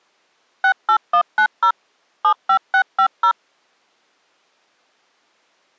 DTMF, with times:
0.6-1.7 68190
2.2-3.3 75650

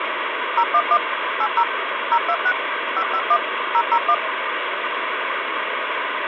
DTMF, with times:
0.6-1.0 011
1.4-1.6 80
2.1-2.5 026
3.0-3.4 551
3.7-4.1 001

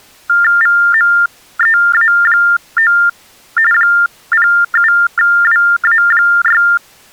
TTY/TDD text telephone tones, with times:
0.6-2.9 VMEA9
3.7-6.6 07WA6

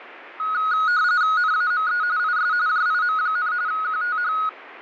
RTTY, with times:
1.4-2.0 NAME
2.2-2.5 IS
2.7-3.5 JIM,
3.7-4.3 QTH

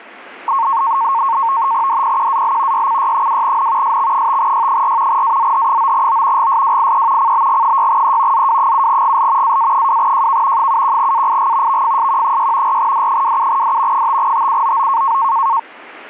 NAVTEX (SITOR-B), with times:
1.9-2.9 DPQAL
2.7-4.0 YCY2N
3.8-5.2 SX5Y4
5.1-6.5 AZH9O
6.4-7.3 GSWIE
7.2-8.5 CBG6E
8.3-9.6 ZW7GL
9.4-10.7 AA2JK
10.6-11.8 71AIG
11.7-12.8 VFSQ6
12.7-14.1 4D27D
13.9-15.2 5TUOO

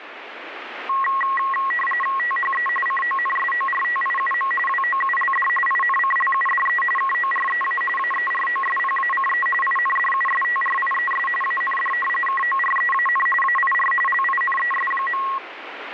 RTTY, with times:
2.2-2.7 THE
2.9-4.5 CONSORTIUM
4.7-5.5 WOULD
5.7-6.8 INCLUDE
7.0-7.8 KOREA
8.0-9.5 AEROSPACE
9.6-11.3 INDUSTRIES
11.4-11.9 AND
12.3-13.3 KOREAN
13.4-13.9 AIR
14.1-15.2 LINES.

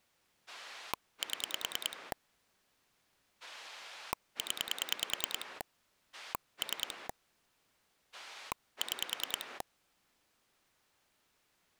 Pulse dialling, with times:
0.5-2.1 7
3.4-5.6 0
6.1-7.1 3
8.1-9.6 6

